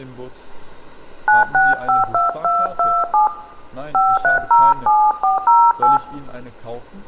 DTMF, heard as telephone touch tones, dialled by hand, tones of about 190 ms, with room echo. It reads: 9652227 5307408